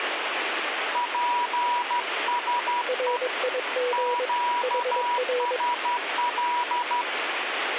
Morse code, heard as two keyed tones, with radio static. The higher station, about 12 wpm, 970 Hz: PSE QSL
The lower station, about 22 wpm, 490 Hz: RIG HR